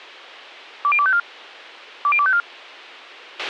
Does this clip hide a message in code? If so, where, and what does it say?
Yes: five-tone selective call (ZVEI) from 0.8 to 2.4 s, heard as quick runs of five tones, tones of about 70 ms, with a squelch burst at the end. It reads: 20254 20254